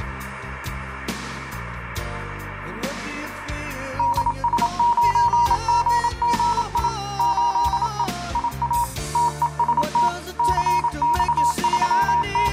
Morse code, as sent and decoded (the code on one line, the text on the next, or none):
-.. ... ----. --. --. .. / ---.. . / .. .- / - . ... - / …
DS9GGI 8E IA TEST …